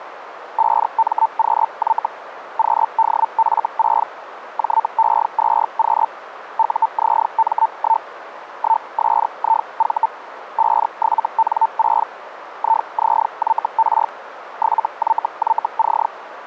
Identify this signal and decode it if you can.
Hellschreiber (Feld-Hell, 122.5 baud), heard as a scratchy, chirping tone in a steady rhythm, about 900 Hz, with radio static. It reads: 5MQY QDF6 JE2Q UZM1 1SIV 57N6 IZYR 7YYC